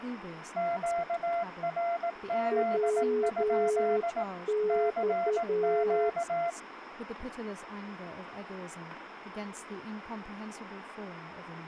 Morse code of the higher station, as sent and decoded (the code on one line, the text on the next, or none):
--.- .-. --.. ..--.. / -.-. --.-
QRZ? CQ